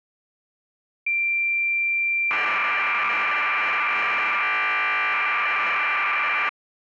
Cassette data (Kansas City type), 1200 baud, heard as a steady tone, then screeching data.